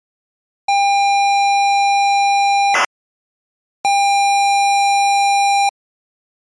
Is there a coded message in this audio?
Yes: ZX Spectrum tape loading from 0.7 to 5.7 s, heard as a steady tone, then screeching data.